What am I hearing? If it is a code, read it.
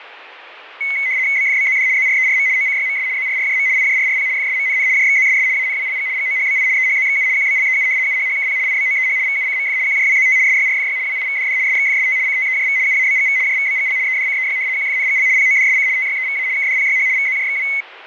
RTTY (75 baud, 170 Hz shift), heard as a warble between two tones, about 2150 Hz centre, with fading. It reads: BFBZD ZRERM OCYMS ZRRJM IJRRP FSMNN JXZSS ANWLG GOHBI EHZXU QBLEU UHHKP IBOEH VUCMF QJWZT SYRFY WIVDD SXFST CTEJV UABGV JVBGL EDCEY QFNGL PODSC TYEVA KDPYH VZJXW